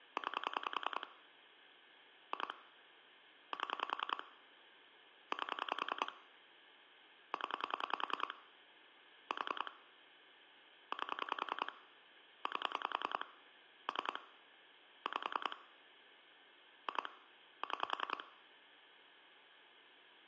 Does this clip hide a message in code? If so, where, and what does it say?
Yes: pulse dialling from 0.2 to 18.2 s, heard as clicks on a phone line, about 10 pulses a second, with phone line noise. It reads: 9 2 7 8 0 4 8 8 3 5 2 6